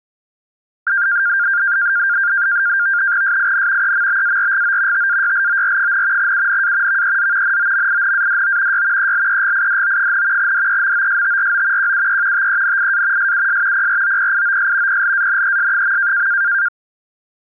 NAVTEX (SITOR-B), 100 baud, 170 Hz shift, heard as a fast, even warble, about 1500 Hz centre. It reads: SIN EMBARGO TAYLOR, UNA VEZ NOMINADO Y ELEGIDO, DEMOSTRO QUE TENIA SUS PROPIOS PLANES.